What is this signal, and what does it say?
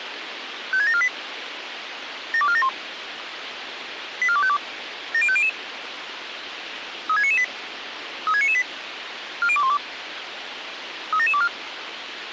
Five-tone selective call (ZVEI), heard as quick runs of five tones, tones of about 70 ms, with radio hiss. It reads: 56748 72471 84252 70500 36998 36998 40212 37724